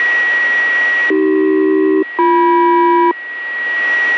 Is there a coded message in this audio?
Yes: aircraft SELCAL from 1.1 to 3.1 s, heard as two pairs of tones, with radio static and a steady whistle near 1910 Hz. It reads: AC-BM